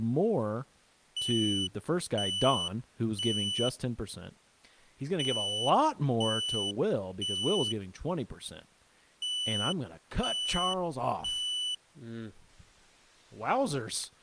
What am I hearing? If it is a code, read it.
Alarm pattern, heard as an alarm's beeps, played three times, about 3000 Hz, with speech in English. Temporal three. Smoke or fire, evacuate.